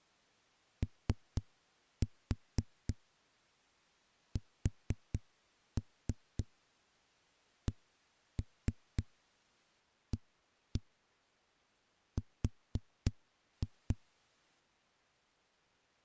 Tap code, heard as knocks on a wall, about 4 knocks a second. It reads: OSCAR